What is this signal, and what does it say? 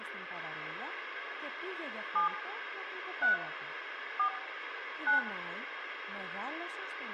DTMF, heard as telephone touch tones, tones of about 100 ms, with phone line noise, room echo and speech in Greek. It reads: 7 3 4 9